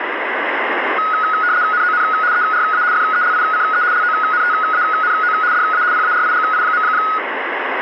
RTTY (75 baud, 170 Hz shift), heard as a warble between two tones, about 1360 Hz centre, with radio static. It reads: NON ERA FELICE LONTANO DA PARIGI.